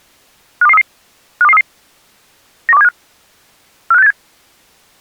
Five-tone selective call (EEA), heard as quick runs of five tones, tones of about 40 ms. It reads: 52233 52233 91275 45687